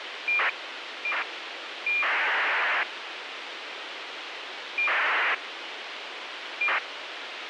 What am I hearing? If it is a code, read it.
ACARS aircraft data, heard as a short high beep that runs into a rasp, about 2400 baud, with radio hiss.